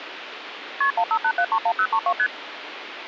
Multi-frequency trunk signalling (R1, as on North American trunks), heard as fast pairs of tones, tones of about 70 ms, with phone line noise. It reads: KP 158731032 ST